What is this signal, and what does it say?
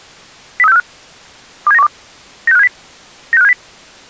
Five-tone selective call (EEA), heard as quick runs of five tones, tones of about 40 ms. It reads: 03645 27912 96570 96570